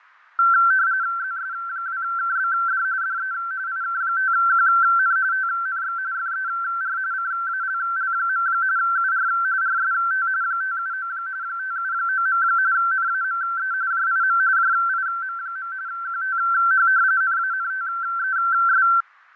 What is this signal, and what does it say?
RTTY (45.45 baud, 170 Hz shift), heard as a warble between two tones, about 1450 Hz centre, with fading. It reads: ZS2KBD DE IK5QN TNX FER CALL. UR RST 579 579. NAME JIM JIM. QTH NANTES